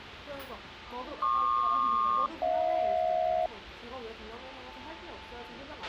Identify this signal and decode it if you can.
Aircraft SELCAL, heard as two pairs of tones, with a squelch burst at the end and the noise of a restaurant. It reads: PQ-HJ